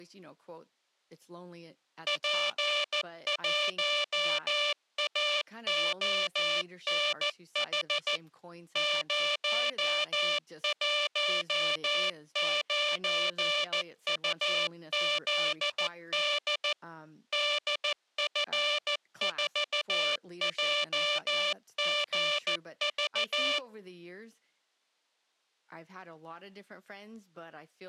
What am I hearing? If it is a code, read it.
Morse code, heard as a buzzer, machine-sent, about 14 wpm, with speech in English. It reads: P1AONH 019UZD DF4JGV